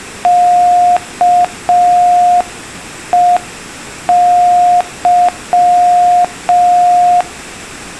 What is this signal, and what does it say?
Morse code, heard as a keyed tone, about 5 wpm, 710 Hz. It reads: KEY